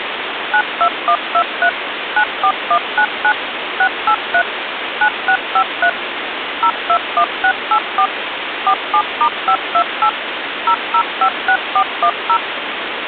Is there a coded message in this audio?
Yes: DTMF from 0.5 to 12.4 s, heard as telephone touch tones, dialled by machine, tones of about 70 ms, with phone line noise. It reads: 92123 94199 683 9653 021684 47*528 0056410